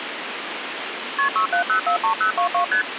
Multi-frequency trunk signalling (R1, as on North American trunks), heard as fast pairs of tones, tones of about 100 ms, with phone line noise. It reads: KP 67043022 ST